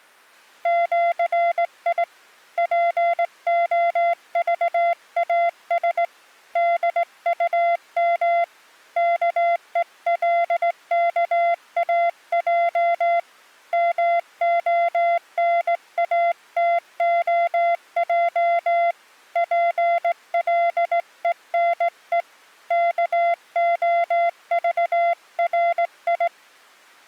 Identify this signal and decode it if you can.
Morse code (with Esperanto letters), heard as a keyed tone, hand-sent with a straight key, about 18 wpm, 690 Hz. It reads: ĜI POVAS DUM KELKAJ MONATOJ PLENE KOVRI